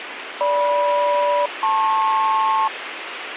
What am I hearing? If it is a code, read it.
Aircraft SELCAL, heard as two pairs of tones, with radio hiss. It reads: GM-LP